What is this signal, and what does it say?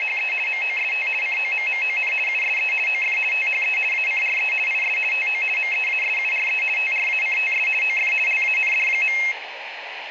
RTTY (50 baud, 450 Hz shift), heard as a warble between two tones, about 2350 Hz centre, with radio static and room echo. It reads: … MOST COMMON USE OF THE ACRE IS TO MEASURE TRACTS OF LAND.